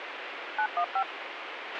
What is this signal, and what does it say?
DTMF, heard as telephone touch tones, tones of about 80 ms, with radio hiss and a squelch burst at the end. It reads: 915